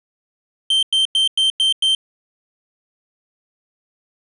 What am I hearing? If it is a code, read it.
Beep code, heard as a piezo beeper, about 3150 Hz. 6 short. In AMI BIOS tables: keyboard controller gate A20 failure; in Dell tables: video card failure.